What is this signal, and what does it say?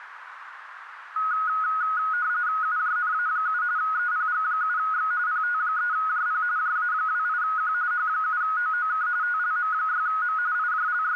RTTY (45.45 baud, 170 Hz shift), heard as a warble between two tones, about 1360 Hz centre, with radio static and a narrow filter. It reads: UJNA7 EPG7X PT3JP JA28Q H7OOK TLM6M …